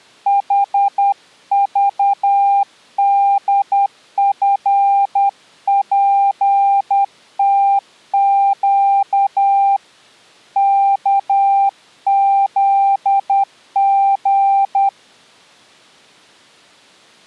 Morse code, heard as a keyed tone, hand-sent with a paddle, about 10 wpm, 790 Hz. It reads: HVDFPTQ KZG